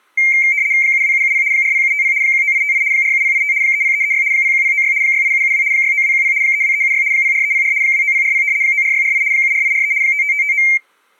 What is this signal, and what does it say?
RTTY (75 baud, 170 Hz shift), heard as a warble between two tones, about 2200 Hz centre. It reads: 72770 40750 19858 47085 30336 01096 68772 69210 32376 04304 29040 94648 74843 55559